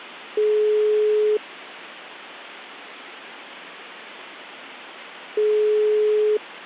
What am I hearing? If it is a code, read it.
Telephone call progress tone (single-tone plan, as in most of Europe), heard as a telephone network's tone, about 420 Hz, 1 s on and 4 s off. Ringback tone.